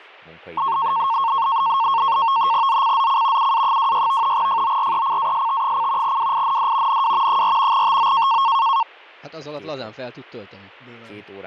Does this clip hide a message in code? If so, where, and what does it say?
Yes: NAVTEX (SITOR-B), 100 baud, 170 Hz shift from 0.6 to 8.8 s, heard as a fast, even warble, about 1000 Hz centre, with speech in Hungarian. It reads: ZCZC UA26 FORECAST: WIND NW 4 TO